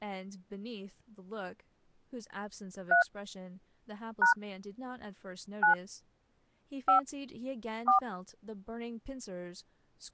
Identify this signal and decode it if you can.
DTMF, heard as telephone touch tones, dialled by hand, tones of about 110 ms, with speech in English. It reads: 3 # 9 5 4